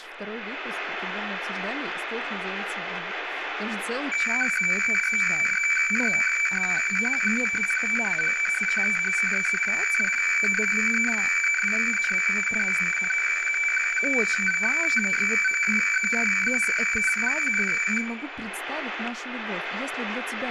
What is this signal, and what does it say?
Weather fax (radiofax), 120 lines a minute, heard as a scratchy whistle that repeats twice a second, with radio static, room echo and speech in Russian.